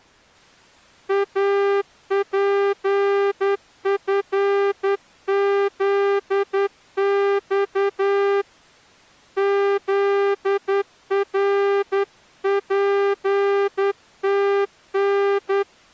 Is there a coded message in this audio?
Yes: Morse code (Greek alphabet) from 1.0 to 15.7 s, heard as a horn, hand-sent with a straight key, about 10 wpm. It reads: ΑΠΦΖΞ ΖΡΠΤΝ